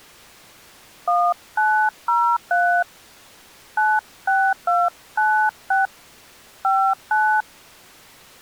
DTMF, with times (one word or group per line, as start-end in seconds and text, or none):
1.1-2.8 1903
3.8-5.9 96296
6.6-7.4 59